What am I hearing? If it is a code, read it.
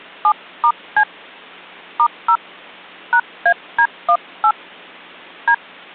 DTMF, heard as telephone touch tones, dialled by hand, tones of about 70 ms. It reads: 7*C *0 #AD18 D